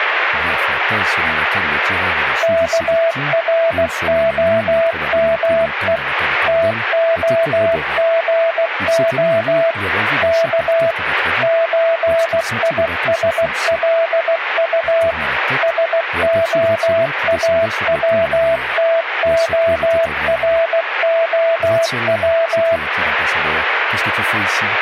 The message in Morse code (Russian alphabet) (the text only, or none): КРОМЕ ТОГО К ЧИСЛУ СОАВТОРОВ